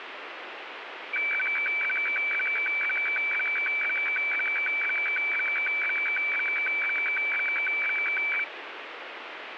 Weather fax (radiofax), 120 lines a minute, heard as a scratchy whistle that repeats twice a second, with radio static.